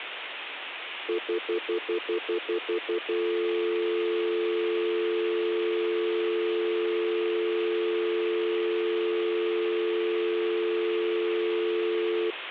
Telephone call progress tone (North American plan), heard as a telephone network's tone, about 350, 440 Hz, 0.1 s on and 0.1 s off, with phone line noise. Stutter dial tone.